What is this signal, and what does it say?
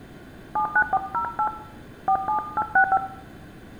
DTMF, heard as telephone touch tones, dialled by hand, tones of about 80 ms, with room echo. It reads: 79408 47865